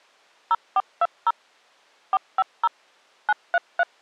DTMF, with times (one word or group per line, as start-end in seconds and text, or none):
0.5-1.3 0420
2.1-2.7 450
3.3-3.8 933